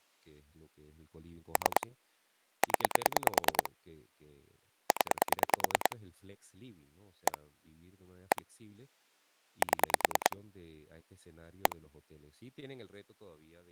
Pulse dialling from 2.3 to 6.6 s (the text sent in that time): 0 0